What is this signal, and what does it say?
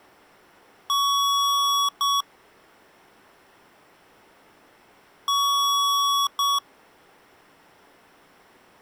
Beep code, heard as beeps from a small speaker, played twice, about 1120 Hz. 1 long, 1 short. In IBM BIOS tables: system board problem.